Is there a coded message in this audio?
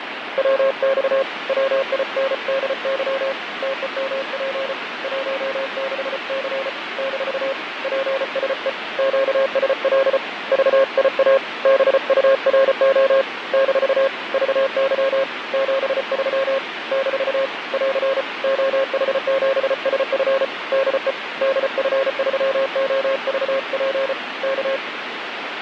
Yes: Morse code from 0.3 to 24.8 s, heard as a keyed tone, hand-sent with a paddle, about 34 wpm, 540 Hz, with radio static and fading. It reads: WX WINDY TEMP 16C - PSE QSL VIA BURO - VY 73 - <AR> OH7SF DE DF3OVP K